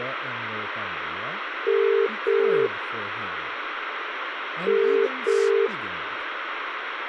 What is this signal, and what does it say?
Telephone call progress tone (as in the UK, Ireland, Australia and similar networks), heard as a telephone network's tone, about 400, 450 Hz, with phone line noise and speech in English. Ringback tone.